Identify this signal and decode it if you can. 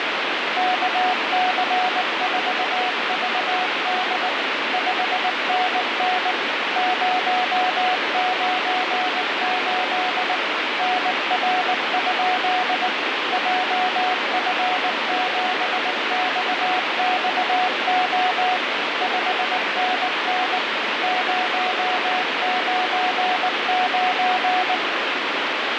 Morse code, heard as a keyed tone, machine-sent, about 19 wpm, 740 Hz, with heavy radio static. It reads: KC4VD 5NN 098 NR? JF7XXO 5NN 099